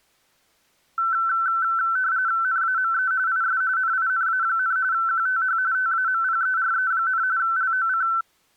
RTTY (45.45 baud, 170 Hz shift), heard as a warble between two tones, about 1430 Hz centre. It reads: NAME IS NINA, QTH TAMPERE, LOC